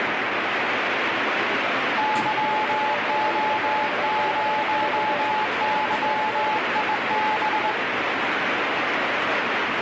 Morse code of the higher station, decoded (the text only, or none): YO0YIB